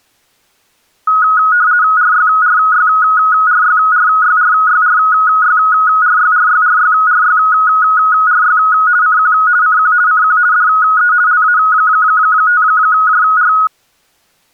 RTTY (50 baud, 170 Hz shift), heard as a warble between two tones, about 1360 Hz centre. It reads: RYRYRYRYRYRYRYRYRYRYRY CQ CQ CQ DE LA5JR